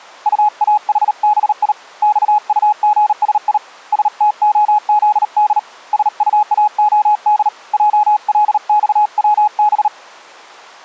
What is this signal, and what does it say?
Morse code, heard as a keyed tone, hand-sent with a paddle, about 38 wpm, 840 Hz. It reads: UAHBI XUGSI STOZD SUAOD JLXWB